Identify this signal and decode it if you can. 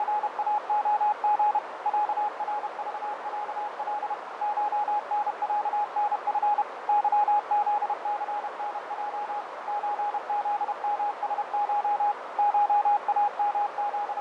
Morse code (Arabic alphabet), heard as a keyed tone, machine-sent, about 31 wpm, 830 Hz, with radio static, fading and a narrow filter. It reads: … عرضعل شنعنف ظذثنج زذمسش …